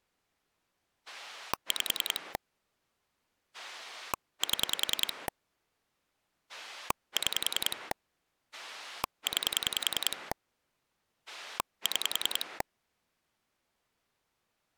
Pulse dialling, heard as a rotary dial, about 10 pulses a second. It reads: 5 7 6 9 6